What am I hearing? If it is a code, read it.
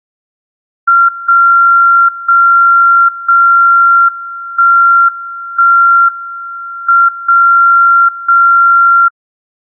Radio time signal (WWVB), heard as a tone whose level steps once a second, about 1380 Hz. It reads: 0 0 0 1 1 M 0 0